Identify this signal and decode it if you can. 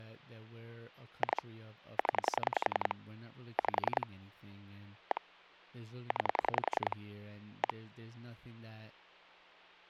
Pulse dialling, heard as clicks on a phone line, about 10 pulses a second, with speech in English. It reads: 2 0 5 1 9 1